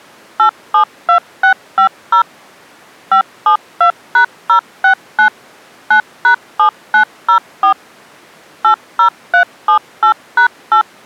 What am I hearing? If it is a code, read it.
DTMF, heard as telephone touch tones, dialled by machine, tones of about 100 ms. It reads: 872650 572#069 9#7904 80378#8